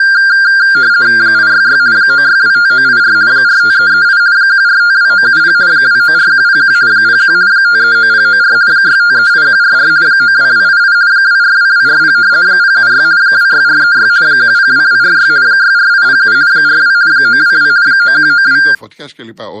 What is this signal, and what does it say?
RTTY (50 baud, 170 Hz shift), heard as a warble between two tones, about 1500 Hz centre, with speech in Greek. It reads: 866 9625984 45338 1452970 294101 01 539094 6538144 92288 242240 076 26436 102246 64807 42 922 9192